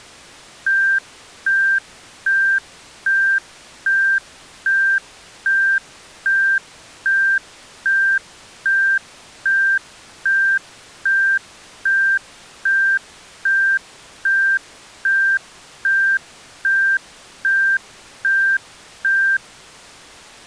Evenly repeated beeps. There is no code.